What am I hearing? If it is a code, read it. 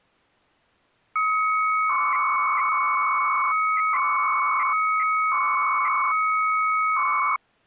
300-baud modem data (Bell 103 tones), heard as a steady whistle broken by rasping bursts, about 300 baud, 200 Hz shift.